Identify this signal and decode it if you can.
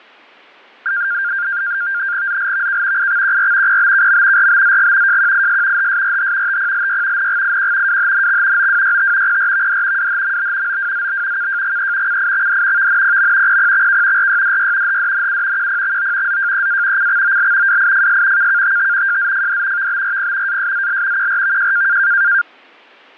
NAVTEX (SITOR-B), 100 baud, 170 Hz shift, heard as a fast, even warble, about 1500 Hz centre. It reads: ZLVK IXQR PBKM RBZG JQIS HSRH TPLY NGIQ WHNX OWYT PRVD WHMB OWZB KJGE CIXD VNPM PPXK RYDY HDNU QPXO ZJEA CXOL WIFS KKTT JZFD VBRP ASZL QRVJ